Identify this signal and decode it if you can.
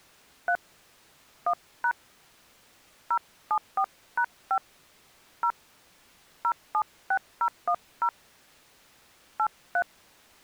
DTMF, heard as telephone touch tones, dialled by hand, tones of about 70 ms. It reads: 3 1# 074#5 0 076010 83